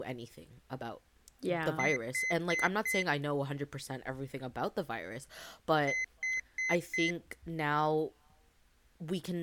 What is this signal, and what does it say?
Beep code, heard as a piezo beeper, played twice, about 2050 Hz, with speech in English. 4 short. In AMI BIOS tables: system timer failure; in Dell tables: memory read or write failure.